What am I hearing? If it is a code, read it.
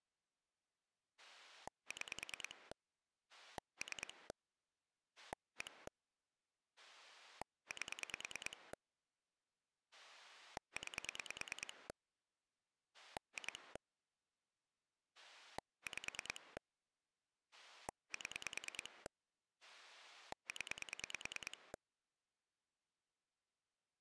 Pulse dialling, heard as a rotary dial, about 9 pulses a second. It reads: 6 3 1 8 9 2 5 7 0